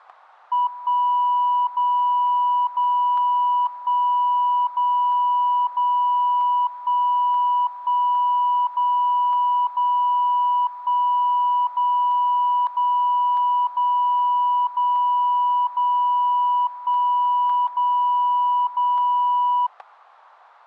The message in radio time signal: 1 0 0 1 0 0 1 1 0 0 1 0 0 0 0 0 1 0 0

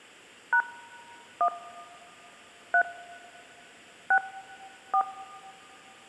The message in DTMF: # 1 3 6 4

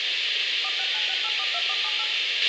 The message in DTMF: 4696842478

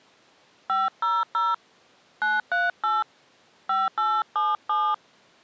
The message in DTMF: 500 938 5877

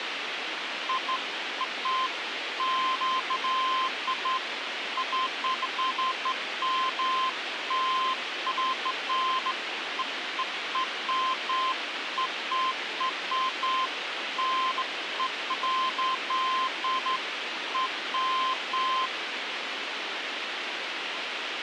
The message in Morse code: none

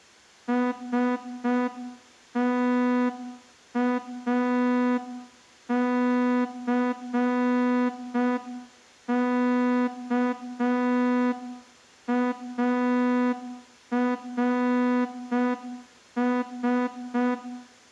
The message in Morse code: STACKARS

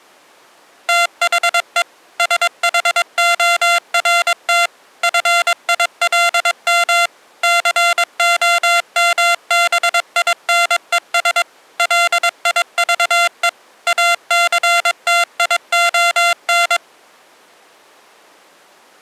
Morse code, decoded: THE SHORT FILM COMBINES LIVE ACTION

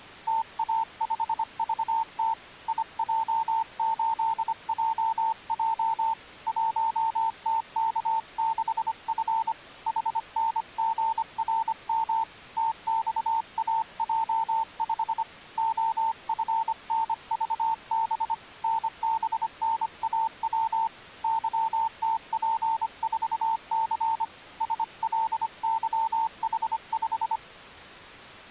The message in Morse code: TA5VT IJ8JJ 1TK6F HNGRM TXAJ5 OFNVB NBNAW YTP4C SLYH5

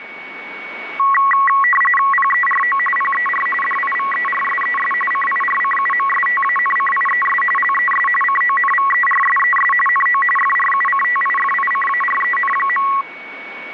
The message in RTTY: PERO PER DIVERSES CIRCUMSTANCIES LES CONVERSES NO FRUCTIFICAREN.

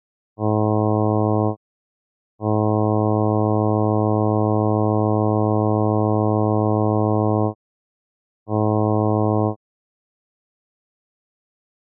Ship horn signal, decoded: 1 short, 1 long, 1 short

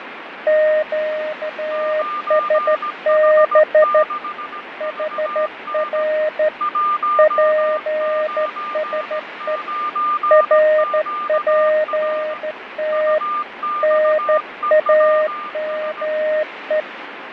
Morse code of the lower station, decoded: QSB HR PSE RPT NAME

